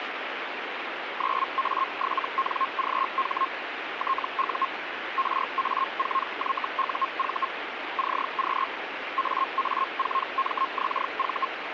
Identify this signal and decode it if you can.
Hellschreiber (Feld-Hell, 122.5 baud), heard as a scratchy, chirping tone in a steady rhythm, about 1070 Hz, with radio static. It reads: 9A7NGH TU RA4YUV CQ AA4MXV